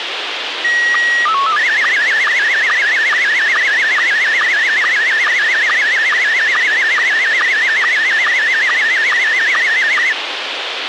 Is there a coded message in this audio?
Yes: SSTV (slow-scan television), Scottie S1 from 0.6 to 10.1 s, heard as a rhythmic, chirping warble, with radio hiss.